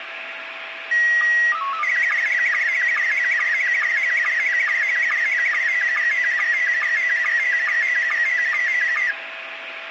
SSTV (slow-scan television), Scottie S1, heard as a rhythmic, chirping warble, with radio static and a steady whistle near 660 Hz.